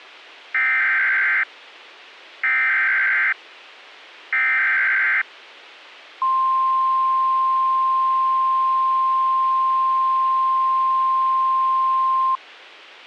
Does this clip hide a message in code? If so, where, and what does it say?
Yes: Emergency Alert System (SAME) tones (header bursts, then the 1050 Hz attention tone) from 0.5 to 12.4 s, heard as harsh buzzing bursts, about 520.83 baud.